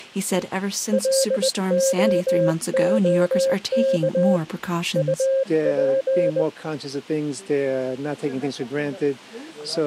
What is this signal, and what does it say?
Morse code, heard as a keyed tone, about 20 wpm, 540 Hz. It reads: LOOK UP